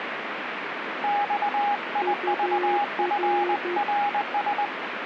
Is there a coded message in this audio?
Yes: Morse code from 1.0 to 4.7 s, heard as two keyed tones, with radio static. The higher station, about 20 wpm, 820 Hz: XIVFRS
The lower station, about 12 wpm, 360 Hz: UR